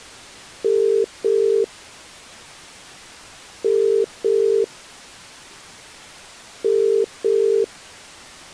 Telephone call progress tone (as in the UK, Ireland, Australia and similar networks), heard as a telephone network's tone, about 400, 450 Hz. Ringback tone.